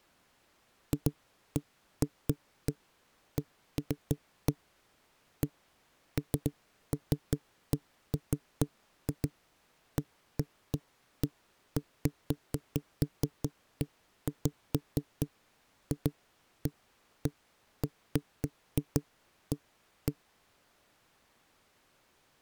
Irregular knocks on a wall. There is no code.